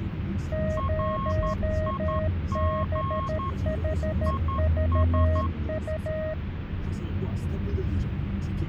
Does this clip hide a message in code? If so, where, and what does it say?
Yes: Morse code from 0.5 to 6.4 s, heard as two keyed tones, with radio static and the noise inside a car. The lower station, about 13 wpm, 630 Hz: 0BHVU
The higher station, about 11 wpm, 1080 Hz: RIG IS